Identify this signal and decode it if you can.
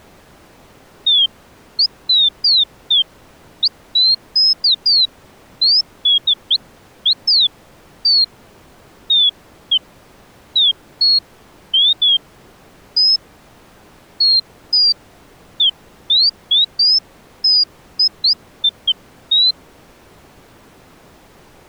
Bird-like chirps. There is no code.